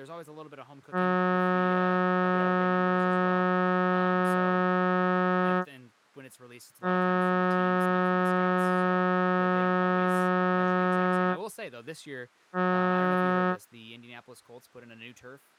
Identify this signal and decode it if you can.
Ship horn signal, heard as a ship's horn, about 180 Hz, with speech in English. 2 long, 1 short. At sea: I intend to overtake on your starboard side.